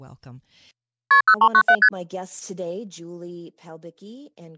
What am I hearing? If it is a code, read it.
Multi-frequency trunk signalling (R1, as on North American trunks), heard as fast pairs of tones, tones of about 70 ms, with speech in English. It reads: KP 0397 ST